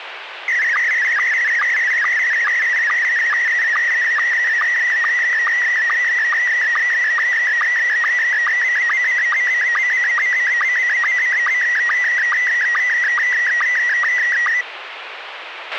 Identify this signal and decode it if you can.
SSTV (slow-scan television), Scottie S1, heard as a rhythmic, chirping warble, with radio hiss and a squelch burst at the end.